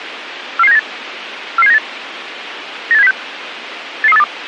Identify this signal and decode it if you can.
Five-tone selective call (EEA), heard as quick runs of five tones, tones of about 40 ms, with radio hiss. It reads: 44798 44798 98706 88382